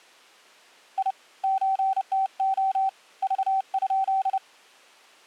Morse code (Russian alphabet), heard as a keyed tone, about 30 wpm, 770 Hz. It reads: И ЧТО Ж?